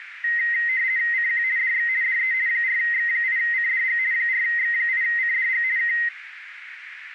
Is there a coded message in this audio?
Yes: RTTY (50 baud, 170 Hz shift) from 0.2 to 6.1 s, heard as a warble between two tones, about 1950 Hz centre, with radio static and a narrow filter. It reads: CQ DX DE 4X8CDG 4X8CDG K